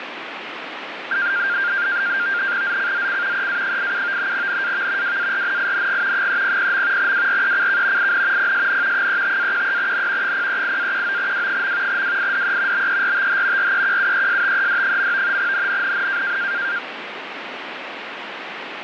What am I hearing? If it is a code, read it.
NAVTEX (SITOR-B), 100 baud, 170 Hz shift, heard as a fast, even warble, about 1500 Hz centre, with radio static. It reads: ZCZC EA87 NAV WARNING 300. WRECK IN PSN 35-13N 038-19W. WIDE BERTH REQUESTED. NNNN